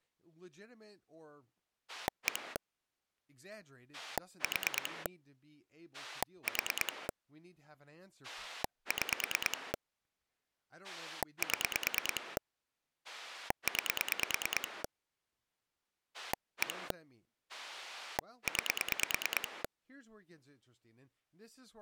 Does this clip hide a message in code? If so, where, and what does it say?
Yes: pulse dialling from 1.9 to 19.7 s, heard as a rotary dial, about 9 pulses a second, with speech in English. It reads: 1 4 4 6 7 9 1 9